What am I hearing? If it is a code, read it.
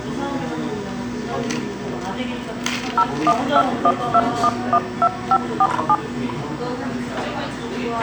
DTMF, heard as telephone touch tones, dialled by machine, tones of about 60 ms, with a squelch burst at the end and the noise of a cafe. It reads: 01212112547